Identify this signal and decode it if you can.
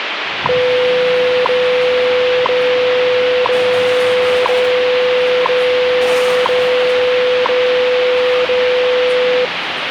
Radio time signal (WWV, Colorado), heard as ticks, one a second, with radio static and the noise of a cafe.